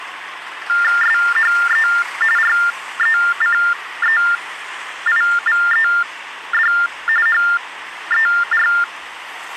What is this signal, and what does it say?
TTY/TDD text telephone tones (45.45 baud Baudot), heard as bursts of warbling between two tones, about 400 Hz shift, 1600 Hz centre, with hum and street noise. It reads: SHE RECEIVED HER